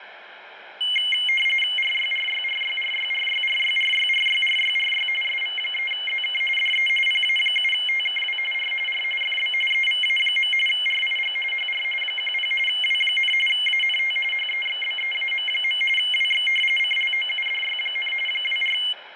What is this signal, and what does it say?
RTTY (45.45 baud, 850 Hz shift), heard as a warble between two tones, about 2550 Hz centre, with radio static and room echo. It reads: RYRYRYRYRYRYRYRYRYRY SV3ZK DE PA7TKW R R FB EVA. RIG HR 10 W, ANT HEXBEAM. WX CLOUDY, 24